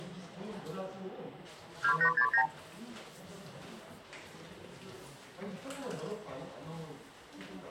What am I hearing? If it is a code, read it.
Multi-frequency trunk signalling (R2, with the far end's replies), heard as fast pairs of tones, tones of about 80 ms, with the noise of a crowd indoors. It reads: 2869